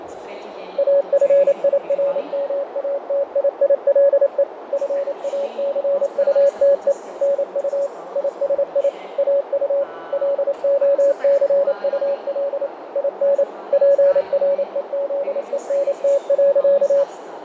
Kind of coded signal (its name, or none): Morse code